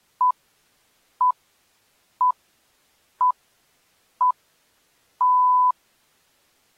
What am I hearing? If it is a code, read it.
Radio time signal (six pips, as the Greenwich Time Signal), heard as pips.